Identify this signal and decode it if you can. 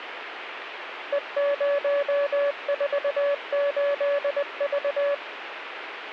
Morse code, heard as a keyed tone, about 20 wpm, 570 Hz, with radio static. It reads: E048V